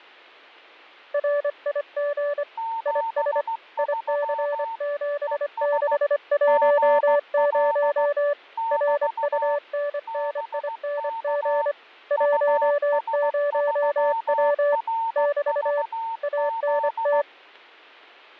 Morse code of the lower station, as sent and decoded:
.-. .. --. / .. ... / .. -.-. --... -.... .---- ----- / .-. ..- -. -. .. -. --. / .---- ----- .-- / -...- / .- -. -
RIG IS IC7610 RUNNING 10W <BT> ANT

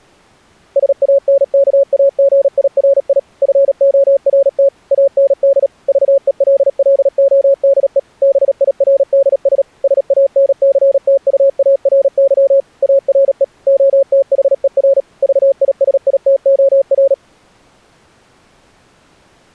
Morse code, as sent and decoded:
... .- -. -.- .- --. .. .-. .. / ..-. --- .-. - / .- -. -.. / ...- . .-.. .-.. --- -.. . / -... .. .-. -.. ... / ... .- -. -.-. - ..- .- .-. -.-- / .- .-. . / --- - .... . .-. / ...- .. ... .. - --- .-.
SANKAGIRI FORT AND VELLODE BIRDS SANCTUARY ARE OTHER VISITOR

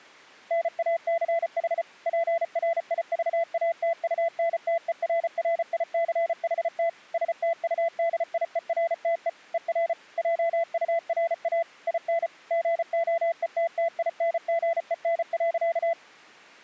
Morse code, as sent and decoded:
-. .- -.-. .... / .--. .-. .. ...- .- - ..- -. - . .-. .-. .. -.-. .... - / ... - ..- -.. .. . .-. - . / . .-. / .--- ..- .-. .- / .. -. / --. --- . - - .. -. --. . -. .-.-.-
NACH PRIVATUNTERRICHT STUDIERTE ER JURA IN GOETTINGEN.

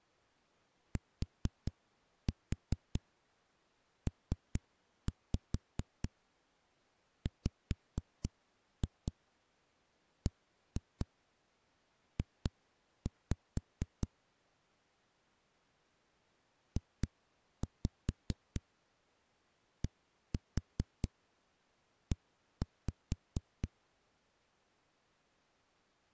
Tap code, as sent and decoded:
4-4 3-5 5-2 1-2 2-5 / 2-5 1-4 1-5
TPWBJ JDE

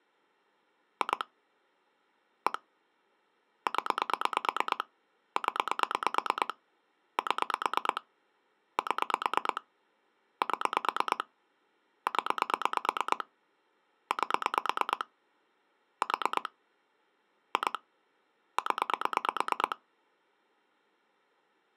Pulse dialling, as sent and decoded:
2 / 1 / 10 / 10 / 7 / 7 / 7 / 10 / 8 / 4 / 2 / 10
2 1 0 0 7 7 7 0 8 4 2 0

